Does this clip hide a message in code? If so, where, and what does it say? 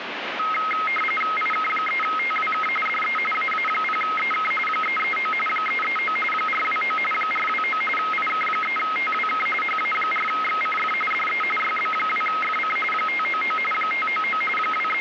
Yes: RTTY (45.45 baud, 850 Hz shift) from 0.4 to 15.0 s, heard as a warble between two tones, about 1700 Hz centre, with radio static. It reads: IK3TWK DE AA0EK 339 339 429 429 IK3TWK HA4XCF DE YB2FC 599 599 …